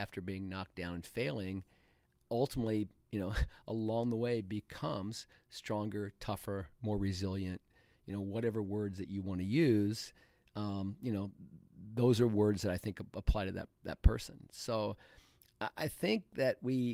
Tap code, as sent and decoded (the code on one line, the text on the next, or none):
none